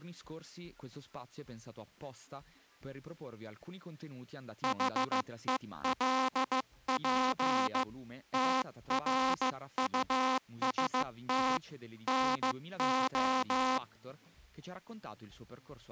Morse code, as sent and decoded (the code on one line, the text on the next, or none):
.... . .-.. .--. / - .-. ..- ... - / -. ---
HELP TRUST NO